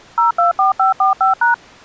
DTMF, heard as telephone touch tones, dialled by machine, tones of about 130 ms. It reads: 024545#